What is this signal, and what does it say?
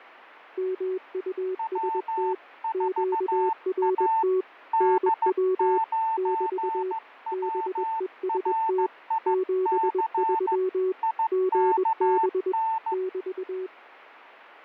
Morse code, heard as two keyed tones, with fading. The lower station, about 21 wpm, 370 Hz: MUST QRT NW <BT> BEST 73 GB <BT>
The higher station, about 15 wpm, 890 Hz: W4A D9WRIC IKN